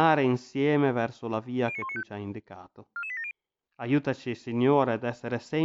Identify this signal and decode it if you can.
Five-tone selective call (ZVEI), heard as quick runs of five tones, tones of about 70 ms, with speech in Italian. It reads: 09195 44870